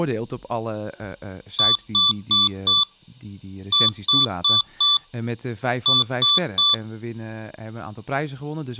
Beep code, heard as beeps from a small speaker, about 1160 Hz, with speech in Dutch. 4-4-3. In Phoenix BIOS tables: maths coprocessor failure.